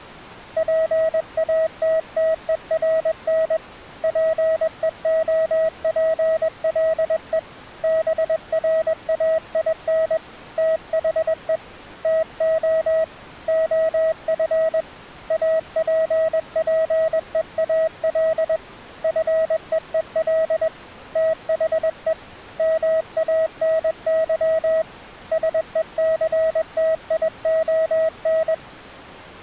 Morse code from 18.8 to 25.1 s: FEEL THE MANY

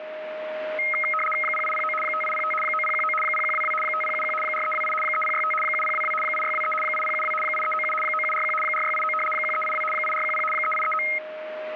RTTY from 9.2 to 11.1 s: 1382 8410 3839

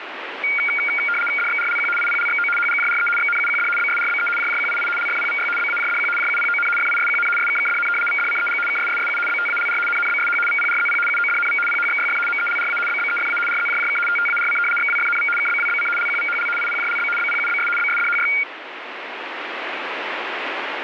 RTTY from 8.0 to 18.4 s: VDCEG KSSSU BTALR NNBSH VPRZP UODNV PHXYF MELRA BBEFA RZJJK TTARC XWFNV KBWBC LQVHL IPJLB BPUBS BSDHY

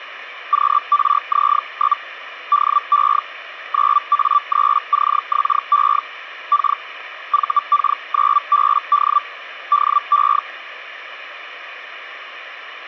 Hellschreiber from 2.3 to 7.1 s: DE 9A3CXE K

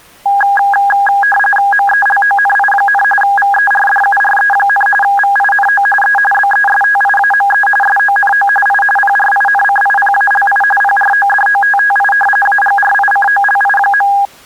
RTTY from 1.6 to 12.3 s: MELONI, VERDURE, VINO E BESTIAME SONO I PRINCIPALI PRODOTTI

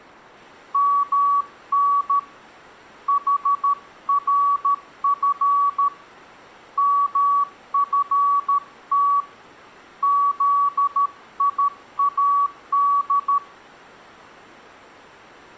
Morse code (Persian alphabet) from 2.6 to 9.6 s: حرف مفت

